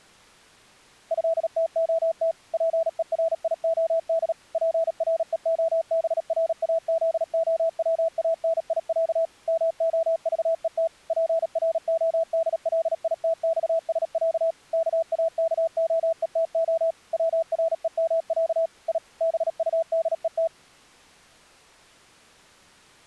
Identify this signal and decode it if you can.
Morse code (Russian alphabet), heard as a keyed tone, machine-sent, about 37 wpm, 660 Hz. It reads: ЭТОТ ПЕРИОД ПРЕОБРАЗОВАНИЯ МОЖЕТ ПРОДЛИТЬСЯ КАКОЕТО ВРЕМЯ И БУДЕТ